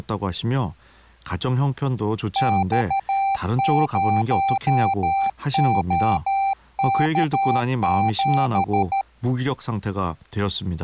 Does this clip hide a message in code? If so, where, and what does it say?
Yes: Morse code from 2.3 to 9.1 s, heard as a keyed tone, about 13 wpm, 780 Hz, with speech in Korean. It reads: X0OK7